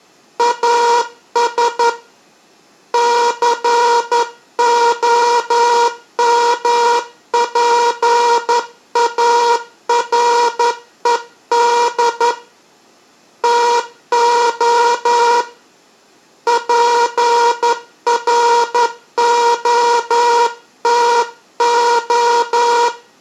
Morse code, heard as a buzzer, hand-sent with a straight key, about 11 wpm, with room echo. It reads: AS COMPARED TO …